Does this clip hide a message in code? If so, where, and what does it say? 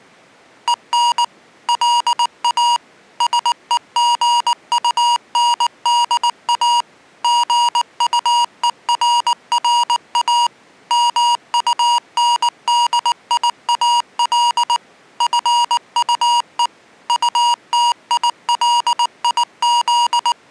Yes: Morse code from 0.6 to 20.5 s, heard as electronic beeps, machine-sent, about 19 wpm, 950 Hz. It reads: EN LA SEGUNDA GUERRA MUNDIAL FUE …